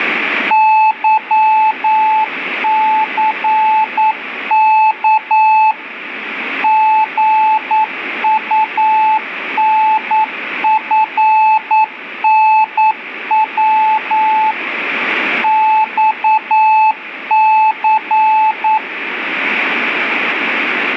Morse code, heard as a keyed tone, machine-sent, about 9 wpm, 870 Hz, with radio static and room echo. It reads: YCK GUNFNW XC